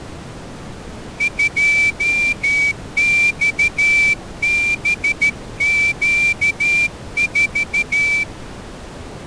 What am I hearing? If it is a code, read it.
Morse code, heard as a whistle, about 13 wpm. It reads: 2XBQ4